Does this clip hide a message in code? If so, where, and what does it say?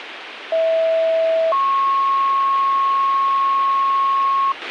Yes: two-tone page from 0.5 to 4.5 s, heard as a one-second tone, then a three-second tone, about 650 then 1090 Hz, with radio hiss and a squelch burst at the end.